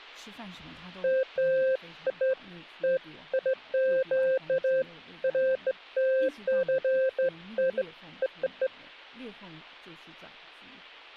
Beeps of irregular length, with speech in Chinese. There is no code.